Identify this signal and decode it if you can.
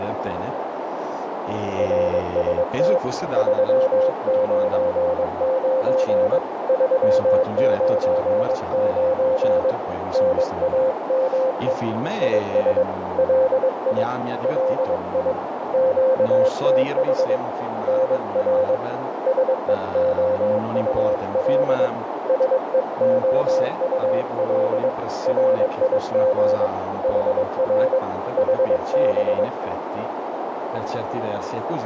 Morse code, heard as a keyed tone, hand-sent with a paddle, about 22 wpm, 520 Hz, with radio static, a narrow filter and speech in Italian. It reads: RST 399 399 NAME IS LI LI QTH NR SEOUL SEOUL RIG HR HB